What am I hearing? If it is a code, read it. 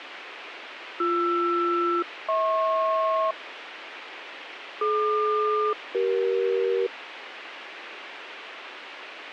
Aircraft SELCAL, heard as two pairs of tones, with radio hiss. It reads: BR-HP DQ-CE